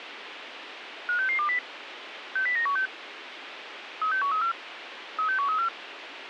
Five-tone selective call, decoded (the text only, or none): 56620 60916 36134 36134